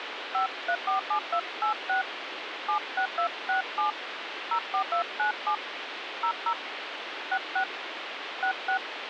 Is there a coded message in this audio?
Yes: DTMF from 0.3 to 8.8 s, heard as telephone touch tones, dialled by hand, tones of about 90 ms, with phone line noise. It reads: 5347286 76267 04297 00 66 66